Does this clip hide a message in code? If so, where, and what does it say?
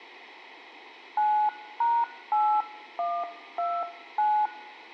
Yes: DTMF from 1.2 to 4.5 s, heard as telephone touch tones, dialled by hand, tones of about 260 ms. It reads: 9#8129